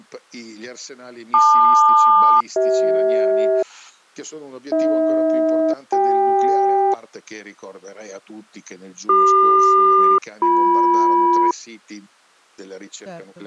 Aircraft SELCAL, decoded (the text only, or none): LQ-CH AH-CK CQ-BM